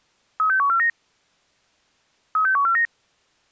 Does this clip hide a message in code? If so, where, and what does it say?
Yes: five-tone selective call (CCIR) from 0.4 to 2.9 s, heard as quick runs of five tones, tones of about 100 ms. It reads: 36149 36149